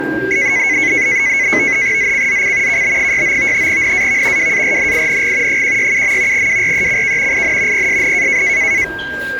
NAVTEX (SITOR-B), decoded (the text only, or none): ZCZC KB69 NAV WARNING 167. WRECK IN PSN